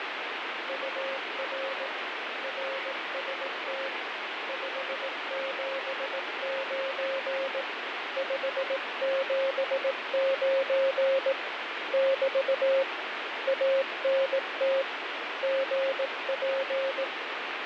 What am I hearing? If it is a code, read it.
Morse code, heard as a keyed tone, hand-sent with a paddle, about 18 wpm, 540 Hz, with heavy radio static and fading. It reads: UR RST 579 579 <BT> ANT GP